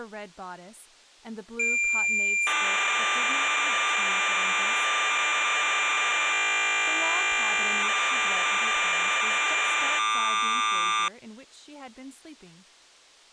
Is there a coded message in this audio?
Yes: cassette data (Kansas City type), 1200 baud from 1.6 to 11.1 s, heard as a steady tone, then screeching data, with speech in English.